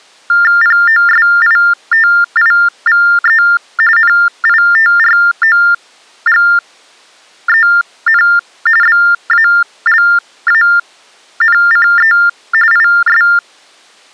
TTY/TDD text telephone tones (45.45 baud Baudot), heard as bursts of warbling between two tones, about 400 Hz shift, 1600 Hz centre. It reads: POSITIVE NITROGEN BALANCE IS